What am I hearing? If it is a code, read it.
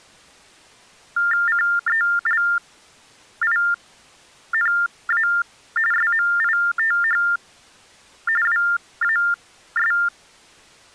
TTY/TDD text telephone tones (45.45 baud Baudot), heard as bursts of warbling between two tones, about 400 Hz shift, 1600 Hz centre. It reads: CELINA SMITH WAS